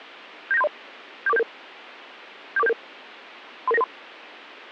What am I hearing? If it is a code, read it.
Five-tone selective call (EIA), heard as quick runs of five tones, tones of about 30 ms. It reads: 79730 74477 74477 33993